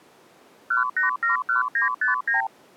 Multi-frequency trunk signalling (R2, with the far end's replies), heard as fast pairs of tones, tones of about 130 ms. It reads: 1871959